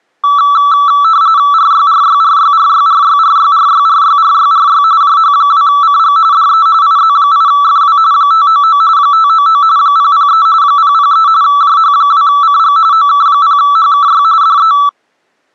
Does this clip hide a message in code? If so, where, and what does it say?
Yes: RTTY (45.45 baud, 170 Hz shift) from 0.2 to 14.9 s, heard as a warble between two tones, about 1230 Hz centre. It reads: RYRYRYRYRYRYRYRYRYRY JH2CG DE IZ8FW 599 599 003 003 JH2CG OK0HKY DE